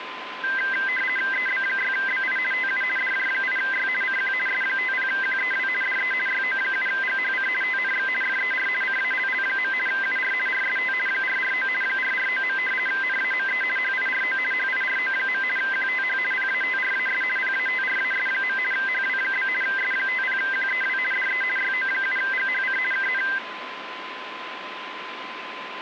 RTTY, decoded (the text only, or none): EB6BI TU DJ8Y CQ S50QEW DE YO7GHC TNX FER CALL. UR RST 449 449. NAME HIRO HIRO. QTH PATRAS PATRAS. HW? S50QEW DE YO7GHC KN